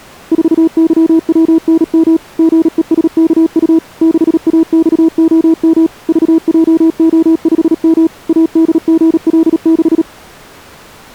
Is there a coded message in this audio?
Yes: Morse code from 0.3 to 10.1 s, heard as a keyed tone, machine-sent, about 37 wpm, 320 Hz. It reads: 4YWNM GESKU 6AXOM VJO5M ADGL6